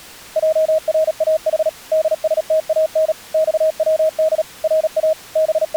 Morse code (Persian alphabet), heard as a keyed tone, machine-sent, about 37 wpm, 630 Hz. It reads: جراح دستان خود را …